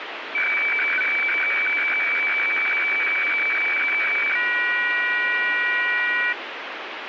Weather fax (radiofax), 120 lines a minute, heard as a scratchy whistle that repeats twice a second, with radio static.